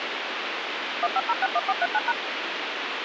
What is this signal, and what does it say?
DTMF, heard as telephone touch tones, dialled by machine, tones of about 40 ms, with radio hiss. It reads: 15061439#